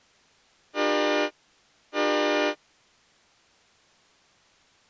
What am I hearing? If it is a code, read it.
Train horn signal, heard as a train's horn. 2 short. On North American railways: a signal is acknowledged.